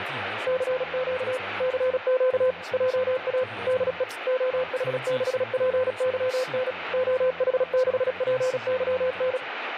Morse code, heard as a keyed tone, machine-sent, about 36 wpm, 510 Hz, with radio static and speech in Chinese. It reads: CQ CQ JA DE OH6PYN OH6PYN